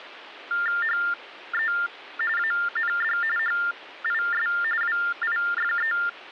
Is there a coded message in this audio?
Yes: TTY/TDD text telephone tones (45.45 baud Baudot) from 0.5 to 6.1 s, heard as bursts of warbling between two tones, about 400 Hz shift, 1600 Hz centre, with phone line noise. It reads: HE AND HIS WIFE